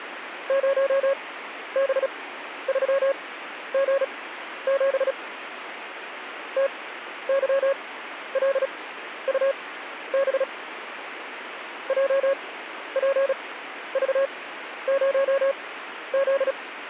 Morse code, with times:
0.5-5.1 0B3G7
6.6-10.4 TYLUB
11.9-16.5 JPV0Z

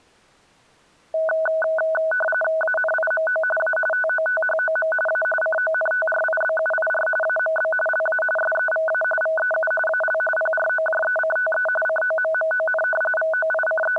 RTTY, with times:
2.6-3.4 ANIMO
3.6-3.8 A
3.9-4.9 TOTHOM
5.1-5.2 A
5.4-7.1 CONTRIBUIR
7.2-7.7 AMB
7.9-8.2 LA
8.4-9.0 SEVA
9.2-9.7 VEU
9.9-10.2 AL
10.4-11.7 PROJECTE
11.9-12.8 COMMON
13.2-14.0 …

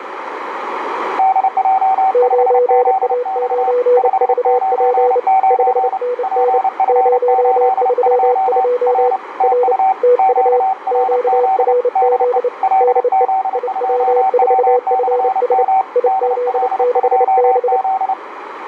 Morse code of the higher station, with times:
1.2-3.7 DJ5ZX
4.0-6.0 599
6.2-8.6 PF82
8.9-9.2 R
9.4-9.9 TU
10.2-11.7 QRZ
12.0-12.4 DE
12.6-15.8 LZ2W/M
16.1-18.1 DL2Z

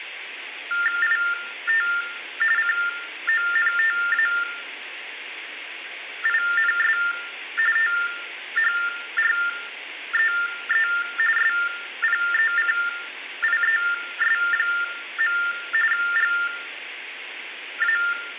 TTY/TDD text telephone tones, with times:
1.0-1.9 IT
2.6-7.0 CONTAINS
7.8-10.9 THREE
11.4-15.4 SPECIES.
15.9-18.0 GA

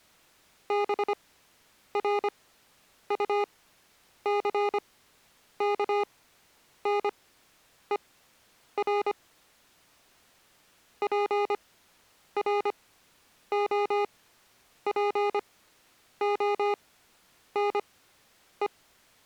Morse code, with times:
0.7-9.1 BRUCKNER
11.0-18.7 PROPONE

